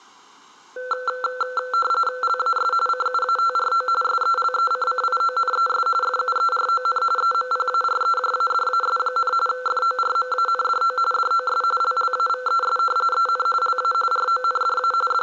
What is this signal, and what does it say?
RTTY (45.45 baud, 850 Hz shift), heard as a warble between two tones, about 930 Hz centre. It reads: LAS CUATRO SELECCIONES FUERON EMPAREJADAS, FORMANDO DOS LLAVES EN LA RONDA …